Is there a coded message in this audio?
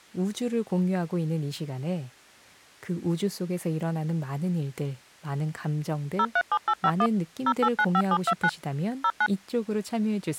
Yes: DTMF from 6.2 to 9.3 s, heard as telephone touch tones, dialled by machine, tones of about 60 ms, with speech in Korean. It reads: 037851 0895729 09